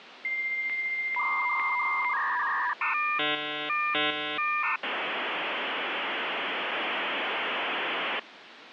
Dial-up modem handshake (V.34 or later), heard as a whistle, warbles, then hiss, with phone line noise.